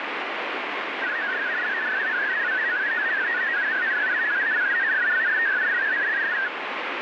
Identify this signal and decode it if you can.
Multi-tone FSK (Olivia or MFSK type), about 500 Hz wide, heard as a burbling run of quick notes, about 62.5 baud, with heavy radio static.